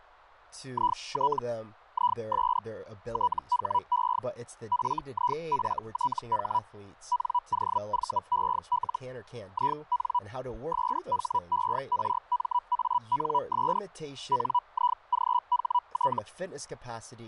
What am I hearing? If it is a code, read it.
Hellschreiber (Feld-Hell, 122.5 baud), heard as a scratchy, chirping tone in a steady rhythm, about 980 Hz, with speech in English. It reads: IT IS THE FIFTH NOVEL IN SHERMANS NIGHT